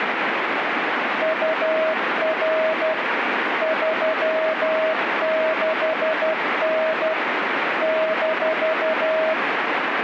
Morse code, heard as a keyed tone, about 12 wpm, 640 Hz, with radio static. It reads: UR 36N -